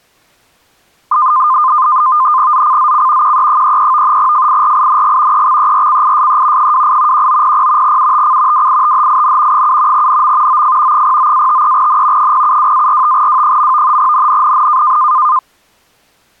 NAVTEX (SITOR-B), 100 baud, 170 Hz shift, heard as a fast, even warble, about 1130 Hz centre. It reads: ZCZC QE33 FIRING EXERCISE 28 1900 UTC WITHIN 7 NM OF 09-53N 072-45W. NNNN